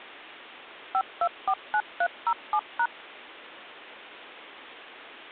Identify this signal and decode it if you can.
DTMF, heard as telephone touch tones, dialled by machine, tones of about 60 ms. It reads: 5249307#